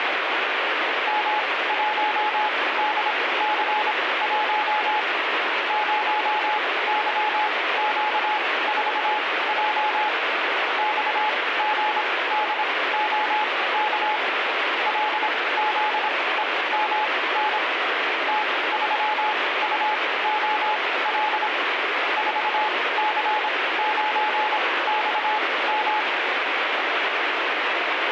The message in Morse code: M1DC1 0YQ4J XGDOK LZEMN T3UOL 4C9XM

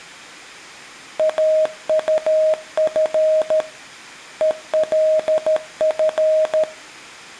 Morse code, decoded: AUF ELF

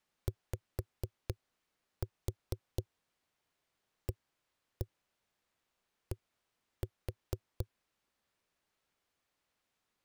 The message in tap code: YAD

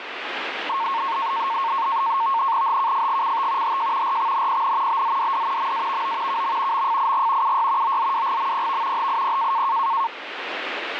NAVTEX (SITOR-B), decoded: HKFGCT HJ RXNPN BZDD MAVO KM MFIG UY OZWGMPV HIP

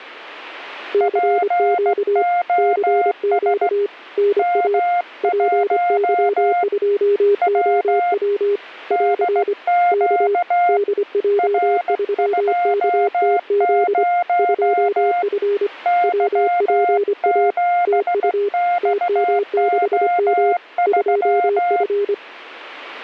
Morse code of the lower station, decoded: CQ CQ NA PY2OW <AR> K DJ3KTZ 2F WPA TU TM6M 2F

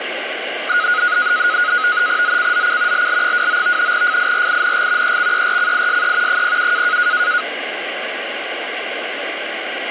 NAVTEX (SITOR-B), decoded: ZCZC LL29 FIRING EXERCISE 07

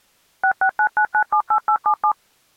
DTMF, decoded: 6699978877

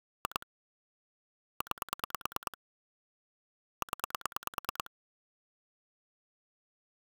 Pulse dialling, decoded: 2 9 0

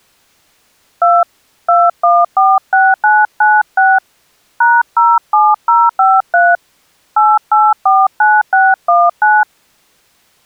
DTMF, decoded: 2 2146996 #07053 8849619

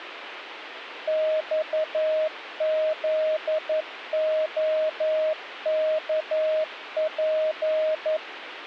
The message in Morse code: XZOKP

